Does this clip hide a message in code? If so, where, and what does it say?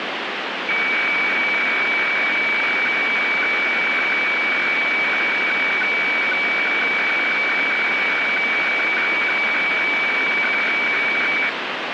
Yes: weather fax (radiofax), 120 lines a minute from 0.7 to 11.5 s, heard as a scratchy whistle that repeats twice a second, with radio static.